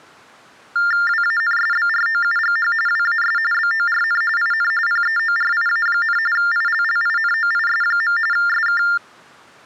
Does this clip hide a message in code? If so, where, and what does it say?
Yes: TTY/TDD text telephone tones (45.45 baud Baudot) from 0.8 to 9.0 s, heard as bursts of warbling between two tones, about 400 Hz shift, 1600 Hz centre. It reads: WANSBROUGH WAS BORN IN PEORIA, ILLINOIS. SK